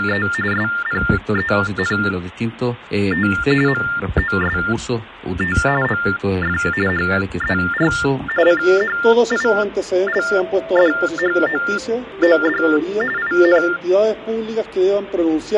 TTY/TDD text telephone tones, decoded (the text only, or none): … SPENT MOST OF HER CHILDHOOD IN